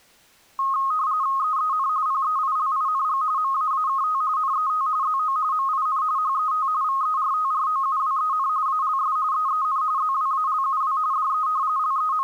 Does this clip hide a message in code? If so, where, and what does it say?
Yes: RTTY (45.45 baud, 170 Hz shift) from 0.6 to 12.2 s, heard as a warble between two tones, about 1170 Hz centre. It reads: EEN PEILING MAAKT NET ZO MIN HET VERTROUWEN ALS EEN ZWALUW DE …